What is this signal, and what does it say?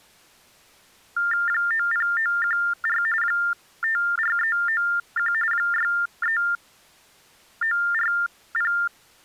TTY/TDD text telephone tones (45.45 baud Baudot), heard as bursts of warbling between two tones, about 400 Hz shift, 1600 Hz centre. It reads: 90914 54391 63940